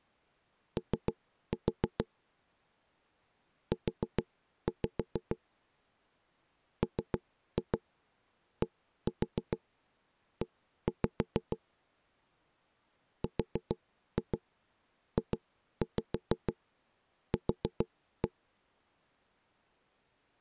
Tap code, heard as knocks on wood, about 6 knocks a second. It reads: O U MDE RJQ